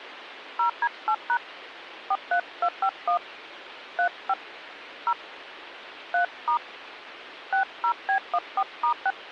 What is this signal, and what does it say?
DTMF, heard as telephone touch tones, dialled by hand, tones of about 80 ms, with phone line noise. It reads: 0D8# 43251 35 0 3* 60B14*6